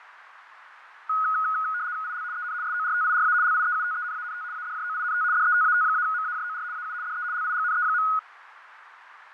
RTTY (75 baud, 170 Hz shift), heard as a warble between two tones, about 1360 Hz centre, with radio static, fading and a narrow filter. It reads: IL EN SORTIRA LIEUTENANT ADJOINT DETAT-MAJOR AU DE LIGNE.